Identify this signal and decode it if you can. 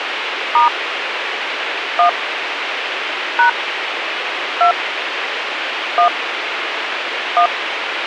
DTMF, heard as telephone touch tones, dialled by hand, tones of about 110 ms, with radio hiss. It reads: * 1 # 2 1 1